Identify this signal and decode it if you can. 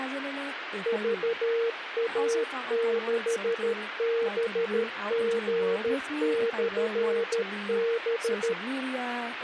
Morse code, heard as a keyed tone, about 13 wpm, 460 Hz, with radio hiss and speech in English. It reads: VA6BG/B